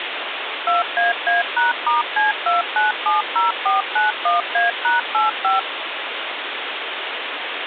DTMF, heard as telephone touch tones, dialled by machine, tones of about 150 ms, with phone line noise. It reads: 2AA#*C2970491A#85